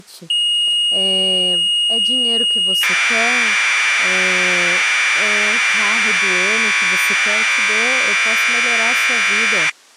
Commodore tape loading (standard loader), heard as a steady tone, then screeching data, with speech in Portuguese.